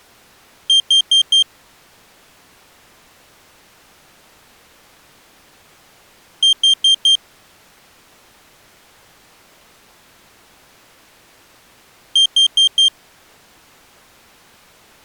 Alarm pattern, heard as an alarm's beeps, played three times, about 3200 Hz. Temporal four. Carbon monoxide.